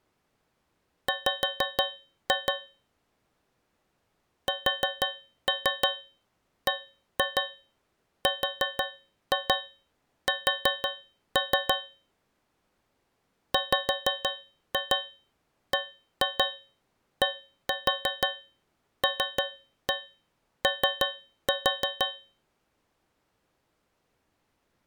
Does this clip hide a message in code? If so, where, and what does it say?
Yes: tap code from 1.1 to 22.4 s, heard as taps on a metal pipe, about 6 knocks a second. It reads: W SBRS WBDLO